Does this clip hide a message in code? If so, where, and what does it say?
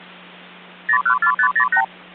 Yes: multi-frequency trunk signalling (R2, with the far end's replies) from 0.9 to 1.8 s, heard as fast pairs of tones, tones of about 80 ms, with hum. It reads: 014508